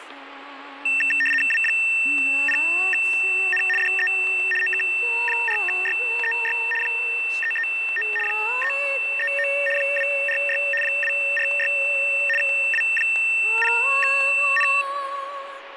RTTY (75 baud, 850 Hz shift), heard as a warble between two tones, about 2250 Hz centre, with radio static and static crashes. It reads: W0N DE OK4YEY 339 339 246 246 W0N